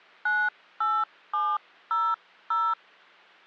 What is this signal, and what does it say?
DTMF, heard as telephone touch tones, dialled by hand, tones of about 240 ms. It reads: 98700